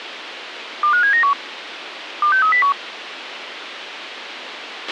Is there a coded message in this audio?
Yes: five-tone selective call (CCIR) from 0.8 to 2.7 s, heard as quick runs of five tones, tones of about 100 ms, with radio hiss and a squelch burst at the end. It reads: 25791 26301